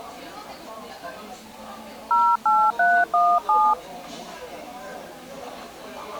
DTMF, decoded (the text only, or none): 08317